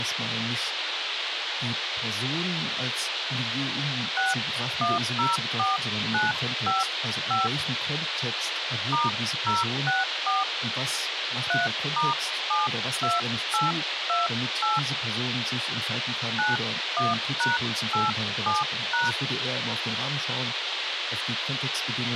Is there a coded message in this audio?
Yes: DTMF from 4.2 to 19.1 s, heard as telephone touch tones, dialled by hand, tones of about 170 ms, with radio hiss. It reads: 6104955 *064 3*72828 91#87#